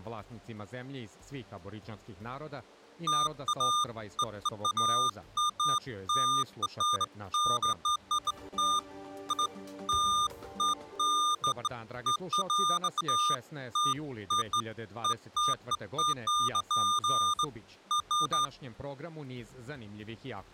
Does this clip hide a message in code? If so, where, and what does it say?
No, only beeps of irregular length.